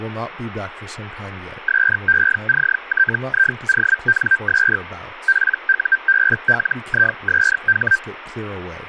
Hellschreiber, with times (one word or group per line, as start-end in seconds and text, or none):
1.7-4.8 SECTIONS
5.3-8.0 PUBLISH